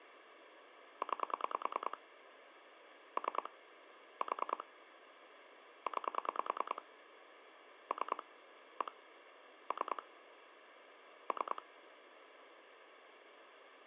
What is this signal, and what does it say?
Pulse dialling, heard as clicks on a phone line, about 10 pulses a second, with phone line noise. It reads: 9 3 4 9 3 1 3 3